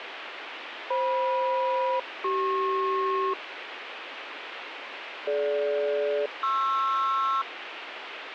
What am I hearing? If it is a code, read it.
Aircraft SELCAL, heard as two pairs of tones, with radio hiss. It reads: FM-CP DG-PR